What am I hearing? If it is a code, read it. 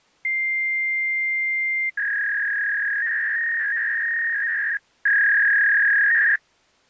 Fax machine handshake, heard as a long tone and a warble.